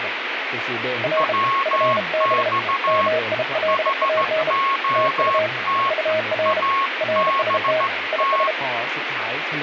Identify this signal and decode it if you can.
Morse code, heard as two keyed tones, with radio static and speech in Thai. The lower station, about 32 wpm, 630 Hz: R FB MILAN TU UR RST IS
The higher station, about 15 wpm, 1090 Hz: WX HOT ABT